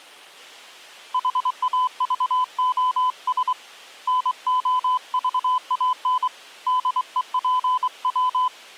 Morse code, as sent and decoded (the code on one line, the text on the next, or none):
.... .- ...- --- ... / -. --- ...- .- -. / -.. . .--. .--
HAVOS NOVAN DEPW